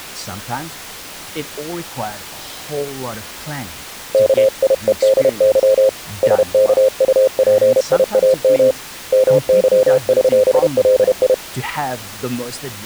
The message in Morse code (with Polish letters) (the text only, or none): KIEDY SKUPIAM MYŚLI